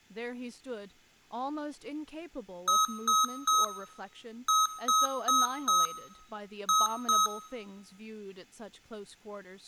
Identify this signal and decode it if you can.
Beep code, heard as beeps from a small speaker, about 1280 Hz, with room echo and speech in English. 3-4-2.